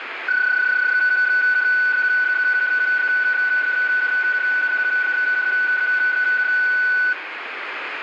PSK31 (31.25 baud), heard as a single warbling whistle, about 1490 Hz, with radio static.